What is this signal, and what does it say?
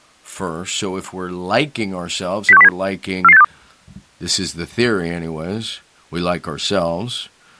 Five-tone selective call (EEA), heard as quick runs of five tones, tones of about 40 ms, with speech in English. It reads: 06107 44862